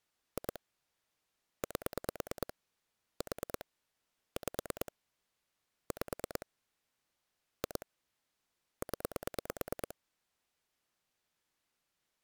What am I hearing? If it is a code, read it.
Pulse dialling, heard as clicks on a phone line, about 9 pulses a second. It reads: 2 8 4 5 5 2 0